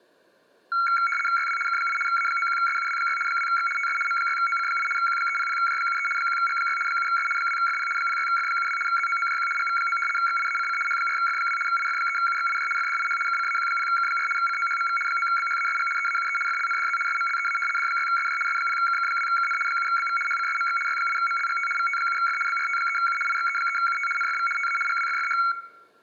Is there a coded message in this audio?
Yes: RTTY (75 baud, 850 Hz shift) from 0.7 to 25.5 s, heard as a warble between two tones, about 1800 Hz centre, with room echo. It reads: YW K8 A91SUW6 2X TS M6OC8 Q300J73 1G6 7S 2FP 06F72 ZOOJQ GV9 XIACC H4F2 IF3UXIJ FDIH KCAQ0K4 COHMV 9BHASG EAUE FLNDZ SMLEA D6SJ S0KK2KN 7BV HCSMX Y8MLGT VT7F BRT3U IXE3UT NFV TA GWFFH